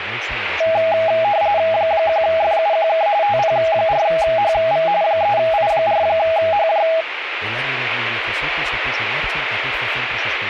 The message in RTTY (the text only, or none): 1FUQK TP4HV 3I4HJ